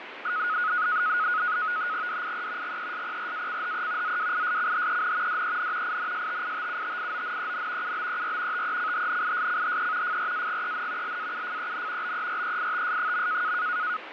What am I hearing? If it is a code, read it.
NAVTEX (SITOR-B), 100 baud, 170 Hz shift, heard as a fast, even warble, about 1360 Hz centre, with radio static and fading. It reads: DIE GESPRACHE ZWISCHEN DEN INSTITUTIONEN UBER TECHNISCHE FRAGEN LAUFEN BEREITS.